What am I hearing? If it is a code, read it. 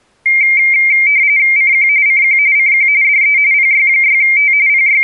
RTTY (45.45 baud, 170 Hz shift), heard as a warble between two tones, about 2200 Hz centre. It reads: CQ CQ CQ DE PY6T …